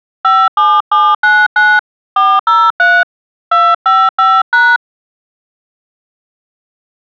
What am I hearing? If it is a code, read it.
DTMF, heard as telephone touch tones, dialled by hand, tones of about 230 ms. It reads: 57799 403 255#